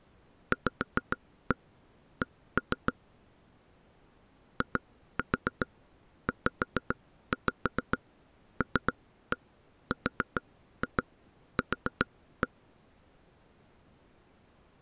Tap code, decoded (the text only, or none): VC IZLRQ